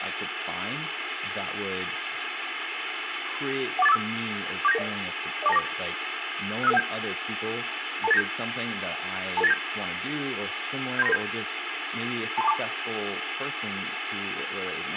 Five-tone selective call (EIA), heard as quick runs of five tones, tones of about 30 ms, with radio hiss, room echo and speech in English. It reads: 14845 47990 04294 65517 22897 22897 73997 23242